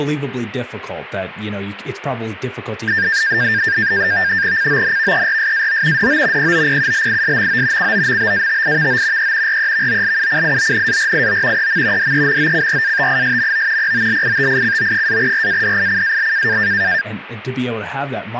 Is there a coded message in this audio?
Yes: NAVTEX (SITOR-B), 100 baud, 170 Hz shift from 2.9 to 17.0 s, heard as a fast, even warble, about 1700 Hz centre, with speech in English. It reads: CONVERSAO DO POPULISMO COMBATIVO E REVOLUCIONARIO EM DEMOCRATISMO POLITICO-RADICAL